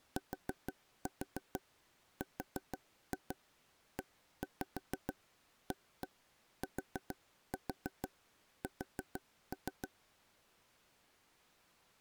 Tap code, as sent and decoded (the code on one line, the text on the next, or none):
4-4 4-2 1-5 1-1 4-4 4-3
TREATS